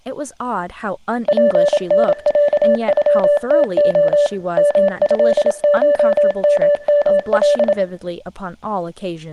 Morse code (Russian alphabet), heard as a keyed tone, machine-sent, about 27 wpm, 580 Hz, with room echo and speech in English. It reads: ПНЯЮТО МЭШММЛ